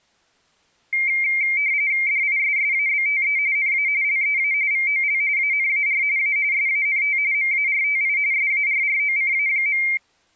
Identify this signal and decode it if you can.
RTTY (45.45 baud, 170 Hz shift), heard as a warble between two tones, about 2200 Hz centre. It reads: DISSABTE NA LEA VOL ANAR A SANT MARTI SARROCA.